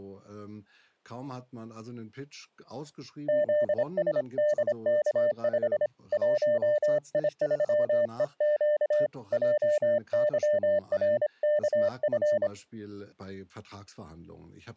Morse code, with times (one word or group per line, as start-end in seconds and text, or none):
3.3-5.9 ZSDK5
6.1-9.1 1I3EQ
9.3-12.5 JYRKF